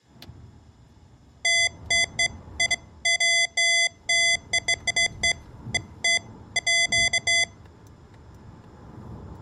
Beeps of irregular length, with room echo and the noise inside a car. There is no code.